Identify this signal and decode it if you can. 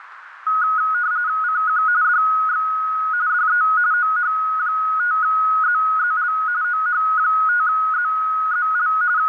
RTTY (45.45 baud, 170 Hz shift), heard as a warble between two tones, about 1360 Hz centre, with radio static and a narrow filter. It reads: CQ DX DE OH5ZZL OH5ZZL …